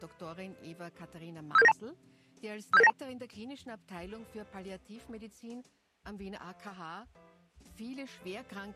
Five-tone selective call (EIA), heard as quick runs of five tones, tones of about 30 ms. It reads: 57792 57792